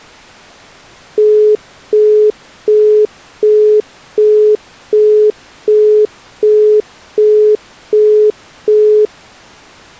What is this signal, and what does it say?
Telephone call progress tone (as in the UK, Australia and similar networks), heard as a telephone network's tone, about 420 Hz, 0.375 s on and 0.375 s off. Busy tone.